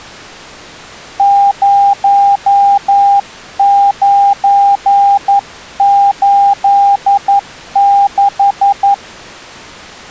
Morse code, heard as a keyed tone, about 11 wpm, 800 Hz. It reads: 0986